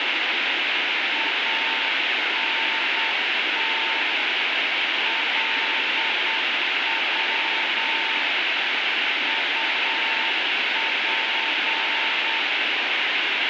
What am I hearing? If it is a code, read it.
Morse code, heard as a keyed tone, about 8 wpm, 900 Hz, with heavy radio static. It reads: ANT LW UP